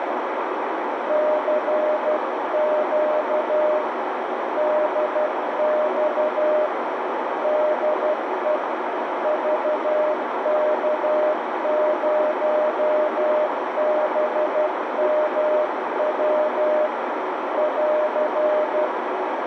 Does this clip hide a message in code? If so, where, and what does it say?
Yes: Morse code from 1.0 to 18.9 s, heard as a keyed tone, hand-sent with a paddle, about 12 wpm, 610 Hz, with heavy radio static and a narrow filter. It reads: CQ DX DE VK0BMW <AR>